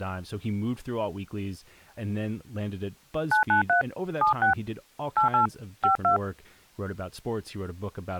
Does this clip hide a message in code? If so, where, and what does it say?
Yes: DTMF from 3.3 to 6.2 s, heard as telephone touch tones, dialled by hand, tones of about 120 ms, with speech in English. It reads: 993 76 88 52